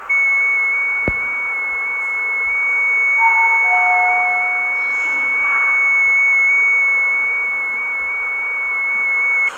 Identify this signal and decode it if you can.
FT8 (one signal), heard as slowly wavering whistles, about 6.25 baud, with fading and the noise inside a lift.